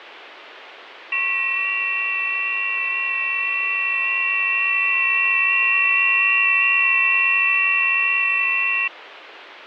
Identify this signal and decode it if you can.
FT8 (several signals at once), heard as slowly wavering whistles, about 6.25 baud, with radio static.